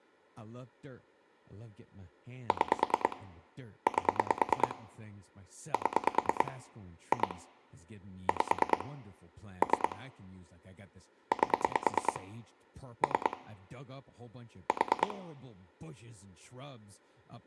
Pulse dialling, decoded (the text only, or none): 6 8 7 2 5 3 8 3 4